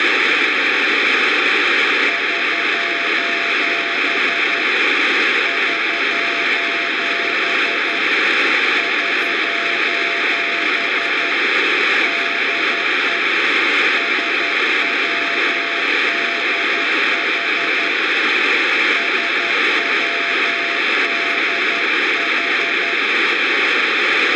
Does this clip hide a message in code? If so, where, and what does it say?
Yes: Morse code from 2.0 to 23.0 s, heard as a keyed tone, hand-sent with a paddle, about 11 wpm, 680 Hz, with radio static, room echo and speech in Turkish. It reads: <SOS> <SOS> <SOS> DE SWDH SWDH